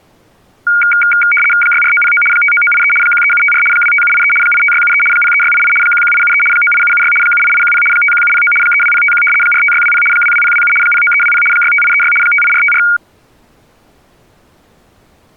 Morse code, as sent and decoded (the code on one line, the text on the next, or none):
none